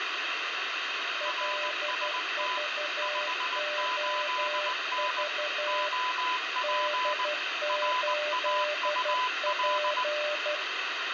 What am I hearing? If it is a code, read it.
Morse code, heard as two keyed tones, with heavy radio static. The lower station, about 12 wpm, 600 Hz: LVOV D8P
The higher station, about 19 wpm, 1000 Hz: RST 58N OP RAUL